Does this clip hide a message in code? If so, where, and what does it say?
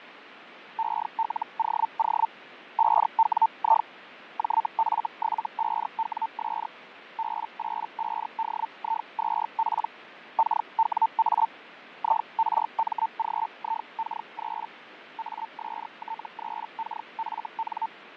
Yes: Hellschreiber (Feld-Hell, 122.5 baud) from 0.8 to 17.9 s, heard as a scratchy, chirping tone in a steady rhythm, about 900 Hz, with radio static and fading. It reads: ELOO 5WI JF75WS B85DI2P KWA IRMGIK3 AST3KFN